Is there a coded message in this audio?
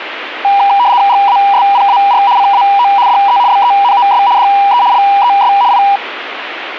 Yes: RTTY (75 baud, 170 Hz shift) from 0.4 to 6.0 s, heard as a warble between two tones, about 880 Hz centre, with radio static. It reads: GASPAR CAO DE BENOS DE LES I